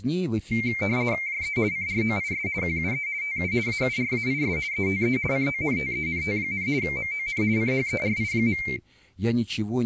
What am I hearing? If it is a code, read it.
RTTY (50 baud, 170 Hz shift), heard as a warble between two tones, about 2200 Hz centre, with speech in Russian. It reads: JE CROIS QUE TU AURAIS ETE CONTENT, MON CHERI.